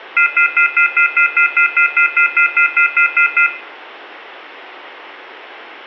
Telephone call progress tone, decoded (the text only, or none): off-hook warning tone